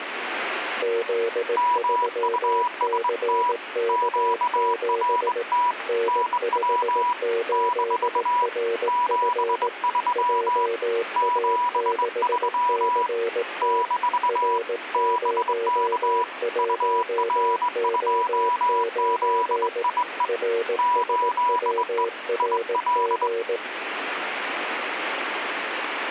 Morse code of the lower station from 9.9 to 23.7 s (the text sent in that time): JA6CT R01O9 RSWRG